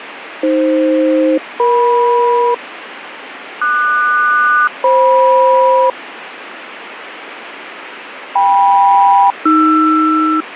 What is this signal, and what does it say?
Aircraft SELCAL, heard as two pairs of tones, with radio static. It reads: AF-EM QS-FM KM-AR